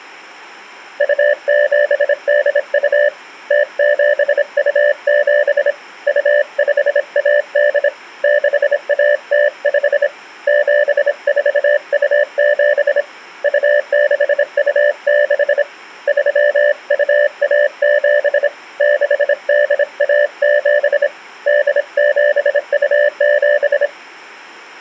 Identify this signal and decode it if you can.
Morse code (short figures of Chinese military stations), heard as a keyed tone, hand-sent with a bug key, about 26 wpm, 590 Hz. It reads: 2782 0727 2518 6105 7427 2626 3217 6817 8727